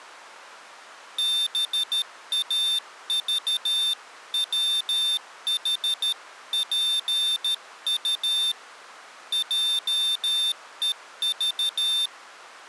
Morse code (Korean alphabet), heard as a high beeper, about 13 wpm, 3600 Hz. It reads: 돌부지 할